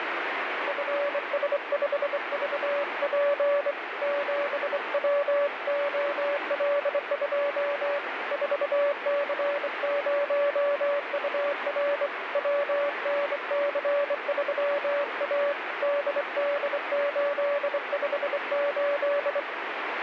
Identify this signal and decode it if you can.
Morse code, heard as a keyed tone, hand-sent with a straight key, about 24 wpm, 570 Hz, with heavy radio static. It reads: FS5VP 7WOL2 4C0UR WNC3A DD858